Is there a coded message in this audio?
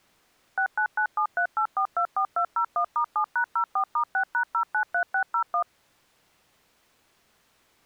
Yes: DTMF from 0.6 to 5.6 s, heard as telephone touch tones, dialled by machine, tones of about 90 ms. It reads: 699738424201*7#04*6#093601